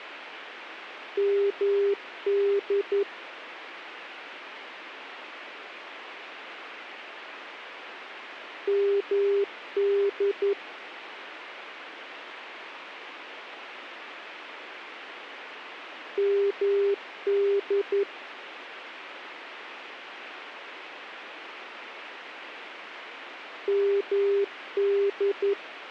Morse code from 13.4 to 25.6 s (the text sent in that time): MD MD